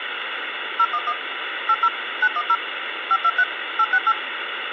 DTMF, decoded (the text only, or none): 011 80 910 523 868